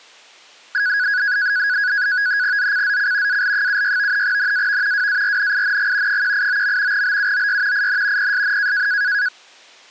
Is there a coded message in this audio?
Yes: NAVTEX (SITOR-B), 100 baud, 170 Hz shift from 0.7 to 9.3 s, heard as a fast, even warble, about 1550 Hz centre. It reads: ZCZC AL76 NAV WARNING 189. BUOY IN PSN